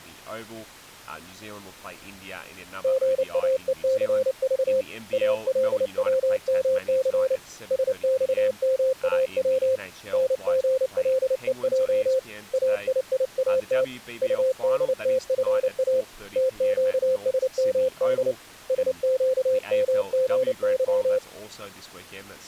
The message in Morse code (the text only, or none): GAECV ALWMC SXMAW NGLEJ AIIAT UDTFA TQSMD SQMGY